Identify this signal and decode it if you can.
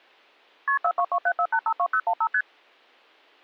Multi-frequency trunk signalling (R1, as on North American trunks), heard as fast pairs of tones, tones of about 70 ms. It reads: KP 42274852015 ST